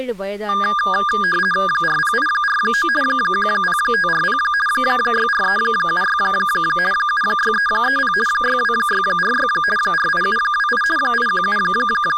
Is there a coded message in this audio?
Yes: RTTY (50 baud, 450 Hz shift) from 0.5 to 12.2 s, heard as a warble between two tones, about 1420 Hz centre, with speech in Tamil. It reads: 40849 10540 64376 76330 62646 48728 …